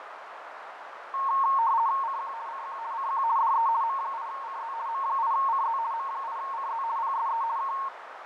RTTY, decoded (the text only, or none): CQ CQ CQ DE M8CZ M8CZ M8CZ PSE K